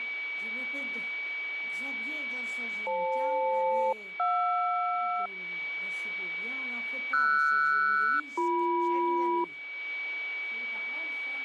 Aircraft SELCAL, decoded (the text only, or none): FL-JR RS-BM